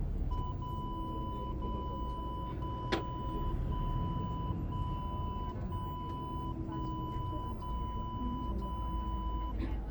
Radio time signal (DCF77), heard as a tone whose level steps once a second, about 1000 Hz, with the noise inside a bus. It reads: 0 0 0 1 1 1 1 0 0